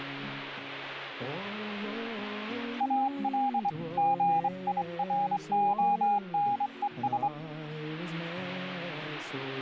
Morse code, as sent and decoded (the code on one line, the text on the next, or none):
.- .-.. / --. .. .-. --- -. . ...
AL GIRONES